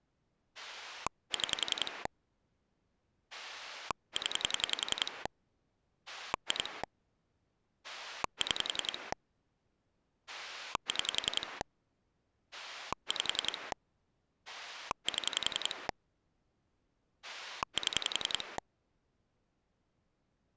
Pulse dialling, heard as a rotary dial, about 10 pulses a second. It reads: 6 0 2 6 6 5 7 7